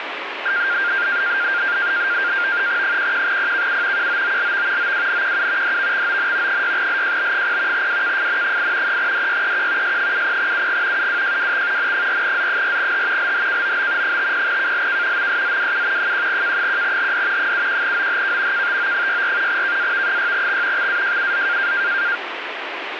NAVTEX (SITOR-B), 100 baud, 170 Hz shift, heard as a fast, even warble, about 1500 Hz centre, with radio static. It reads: 11PKU QOOLV OWNQU DVXON 6LJB0 WKFN8 3DYEQ S70UG UWJWX N4Z4H LHKOB 50KLK MSZWU 1K1HD 71OHK KTO64 KAV6X XAJUZ